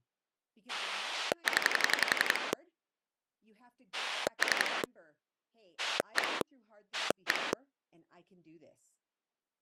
Pulse dialling, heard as a rotary dial, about 11 pulses a second, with speech in English. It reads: 0 3 1 1